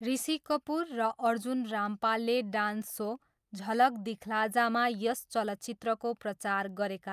Speech in Nepali. There is no code.